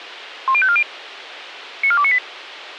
Five-tone selective call (ZVEI), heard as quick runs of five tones, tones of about 70 ms, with radio hiss and a squelch burst at the end. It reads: 10540 94298